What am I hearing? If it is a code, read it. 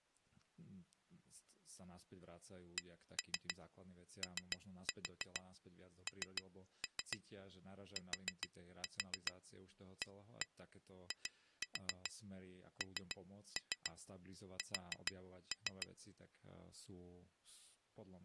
Tap code, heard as taps on glass, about 7 knocks a second, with speech in Slovak. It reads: CONTAINS